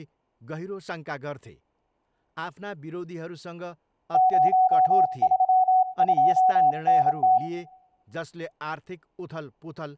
Morse code, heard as a keyed tone, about 27 wpm, 750 Hz, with room echo and speech in Nepali. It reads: 032NT